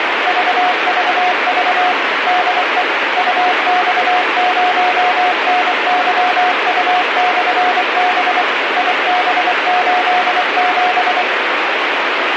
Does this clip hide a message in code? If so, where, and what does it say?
Yes: Morse code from 0.2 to 11.3 s, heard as a keyed tone, machine-sent, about 24 wpm, 720 Hz, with heavy radio static. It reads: VVV DE UX0NYU/B IB87